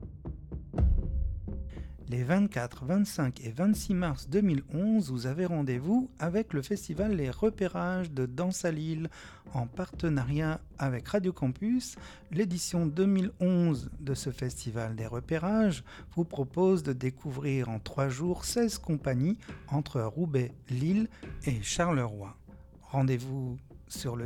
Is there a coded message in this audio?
No.